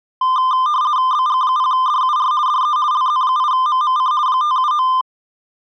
RTTY (50 baud, 170 Hz shift), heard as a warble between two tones, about 1120 Hz centre. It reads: BG0DUR DE LZ8MMC 579